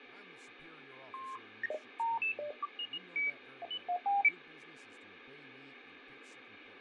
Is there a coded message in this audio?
No, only electronic bleeps of random pitch and length, with radio static, fading and speech in English.